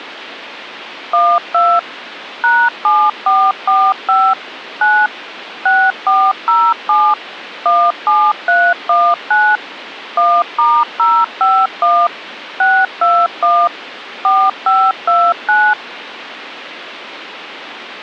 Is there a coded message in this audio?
Yes: DTMF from 1.1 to 15.7 s, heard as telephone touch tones, dialled by machine, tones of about 250 ms, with phone line noise. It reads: 12 #7445 9 6407 17319 1*051 621 4529